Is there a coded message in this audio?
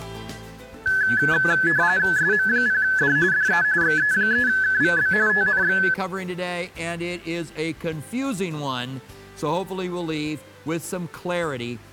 Yes: RTTY (45.45 baud, 170 Hz shift) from 0.9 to 5.9 s, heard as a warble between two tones, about 1600 Hz centre. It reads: SM0D DE XE3KVB TNX